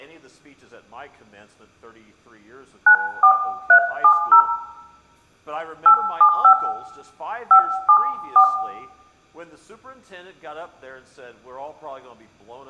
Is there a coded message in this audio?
Yes: DTMF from 2.9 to 8.4 s, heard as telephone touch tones, dialled by hand, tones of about 90 ms, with room echo. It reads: 94370 875 574